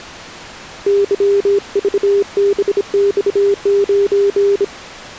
Morse code, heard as a keyed tone, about 26 wpm, 400 Hz. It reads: YVBX9